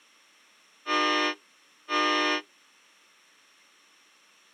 Train horn signal, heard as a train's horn. 2 short. On North American railways: a signal is acknowledged.